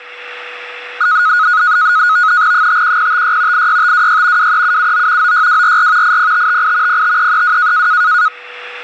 NAVTEX (SITOR-B), 100 baud, 170 Hz shift, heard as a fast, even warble, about 1360 Hz centre, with a steady whistle near 490 Hz. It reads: 51056 86526 23779 96244 80558 05332